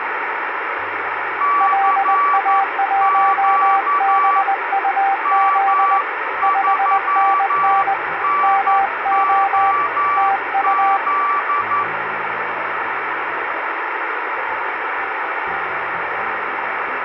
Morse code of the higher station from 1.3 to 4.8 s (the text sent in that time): CQ